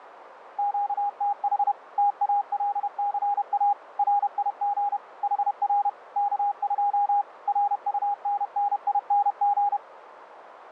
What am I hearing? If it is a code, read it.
Morse code, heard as a keyed tone, machine-sent, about 31 wpm, 810 Hz, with radio static. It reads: QTH TALCA RIG HR K2 RUNNING